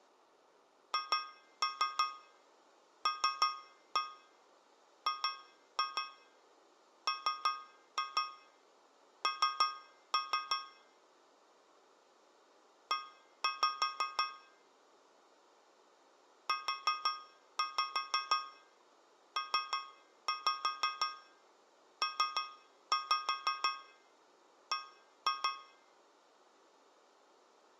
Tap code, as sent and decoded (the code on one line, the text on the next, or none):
2-3 3-1 2-2 3-2 3-3 / 1-5 / 4-5 3-5 3-5 1-2
HLGMN E UPPB